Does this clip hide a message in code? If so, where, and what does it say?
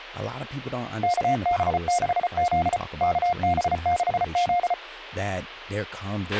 Yes: Morse code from 1.0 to 4.8 s, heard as a keyed tone, machine-sent, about 34 wpm, 710 Hz, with a squelch burst at the end and speech in English. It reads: KB6Z KB6Z